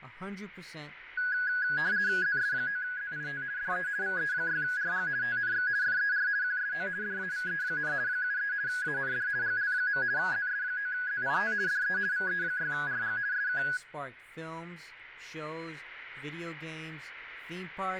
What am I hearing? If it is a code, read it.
RTTY (50 baud, 170 Hz shift), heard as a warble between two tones, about 1550 Hz centre, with radio static and speech in English. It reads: ZS9ZIT DE VE6RG TNX FER QSO DAVE, 73 AND GL. ZS9ZIT DE VE6RG SK